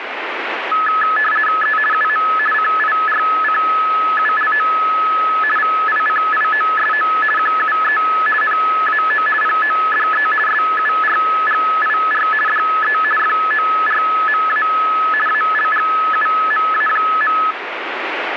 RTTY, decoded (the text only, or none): E UM CIRCULO VICIOSO QUE NAO PODE SURGIR DE FORMA ALGUMA.